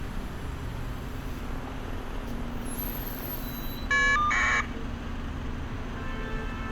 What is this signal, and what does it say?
Caller ID data burst, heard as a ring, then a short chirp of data, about 1200 baud, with street noise.